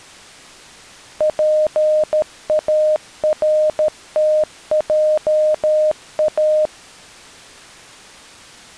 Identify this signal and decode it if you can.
Morse code, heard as a keyed tone, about 13 wpm, 620 Hz. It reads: PARTJA